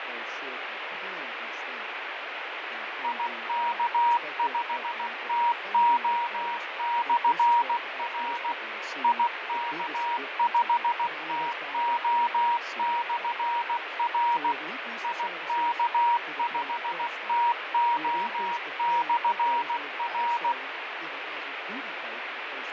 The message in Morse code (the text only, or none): IK5TO/R IK5TO/R IK5TO/R